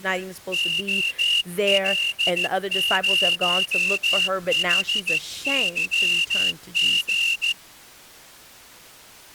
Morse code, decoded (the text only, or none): OL0HYG